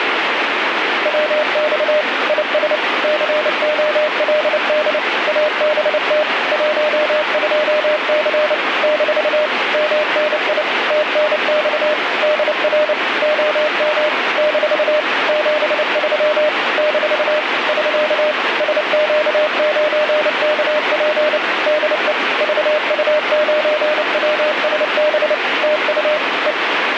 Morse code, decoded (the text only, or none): WX IS COLD ABT 12C - MNI TNX DR OM - 73 - <SK> SQ9KP DE VU9WSB TU E